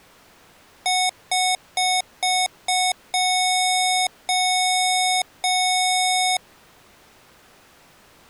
Beep code, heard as beeps from a small speaker, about 740 Hz. 5 short, 3 long.